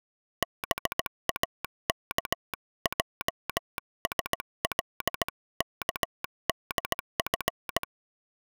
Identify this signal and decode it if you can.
Morse code (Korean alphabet), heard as a telegraph sounder, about 17 wpm. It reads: 동혁은